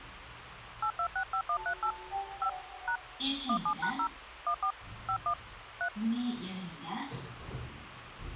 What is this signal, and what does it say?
DTMF, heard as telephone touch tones, dialled by hand, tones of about 80 ms, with phone line noise and the noise inside a lift. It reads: 8265138 5 # 17#0 14 51 3